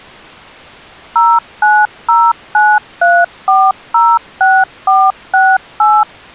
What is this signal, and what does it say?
DTMF, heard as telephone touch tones, dialled by machine, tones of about 230 ms. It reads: 09093406468